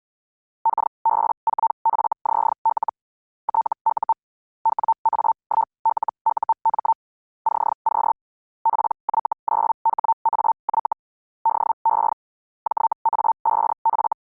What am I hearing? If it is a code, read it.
Hellschreiber (Feld-Hell, 122.5 baud), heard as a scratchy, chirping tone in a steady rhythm, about 900 Hz. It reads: KB4FZL TU WA1LUM CQ PY9HAY DE JA5F